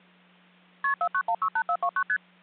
Multi-frequency trunk signalling (R1, as on North American trunks), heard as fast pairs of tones, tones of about 70 ms, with hum. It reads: KP 49168429 ST